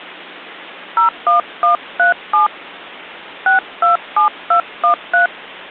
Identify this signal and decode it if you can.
DTMF, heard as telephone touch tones, dialled by hand, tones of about 110 ms. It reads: 01137 627213